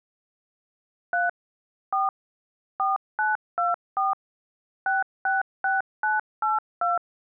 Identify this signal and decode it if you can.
DTMF, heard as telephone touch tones, dialled by machine, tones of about 160 ms. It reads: 3 4 4924 666982